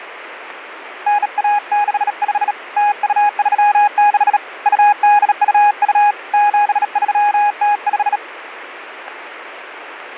Morse code (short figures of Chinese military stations), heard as a keyed tone, hand-sent with a bug key, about 37 wpm, 830 Hz, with radio static. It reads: 9165 0236 2822 7305